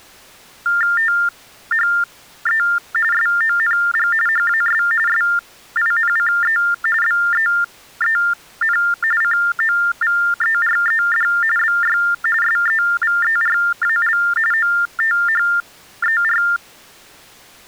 TTY/TDD text telephone tones (45.45 baud Baudot), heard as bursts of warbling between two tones, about 400 Hz shift, 1600 Hz centre. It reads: THE SONG HAS SINCE BEEN COVERED BY SEVERAL OTHER